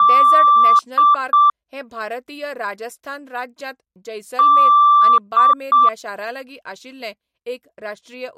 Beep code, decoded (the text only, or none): 1 long, 2 short